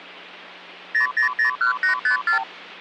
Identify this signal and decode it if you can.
Multi-frequency trunk signalling (R2, with the far end's replies), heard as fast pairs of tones, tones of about 110 ms, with hum. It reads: 0001854